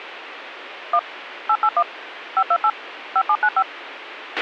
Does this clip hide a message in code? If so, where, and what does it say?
Yes: DTMF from 0.9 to 3.6 s, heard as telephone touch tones, dialled by machine, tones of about 60 ms, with radio hiss and a squelch burst at the end. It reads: 1 881 528 5795